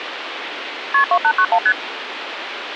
Multi-frequency trunk signalling (R1, as on North American trunks), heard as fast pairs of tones, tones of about 70 ms, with phone line noise. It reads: KP 2891 ST